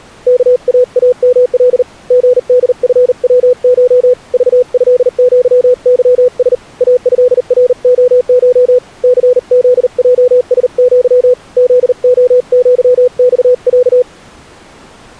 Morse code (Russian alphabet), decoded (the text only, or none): КААМЛ ГДФВШ ЖЭЪЫС АЭРОШ ЦЗЙСЪ ЗОЪЬЯ